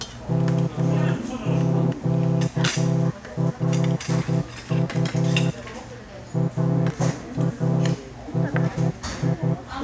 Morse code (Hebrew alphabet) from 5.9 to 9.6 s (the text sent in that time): ראשי